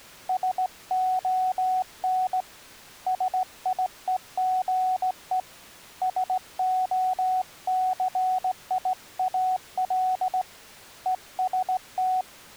Morse code, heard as a keyed tone, hand-sent with a straight key, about 17 wpm, 740 Hz. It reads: SON SIEGE SOCIAL EST